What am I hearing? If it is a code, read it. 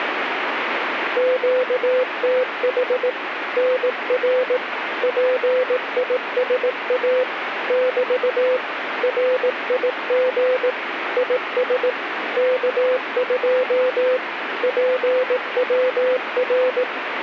Morse code, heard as a keyed tone, machine-sent, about 18 wpm, 510 Hz, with radio static. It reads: QTH NR PISA <BT> RIG IS K2 PWR